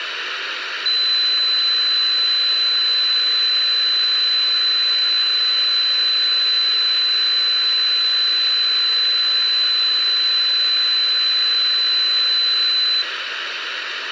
A steady tone, with radio hiss. There is no code.